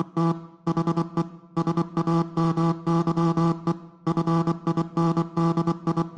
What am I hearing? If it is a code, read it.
Morse code, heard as a buzzer, machine-sent, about 24 wpm. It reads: … HE SAMYE …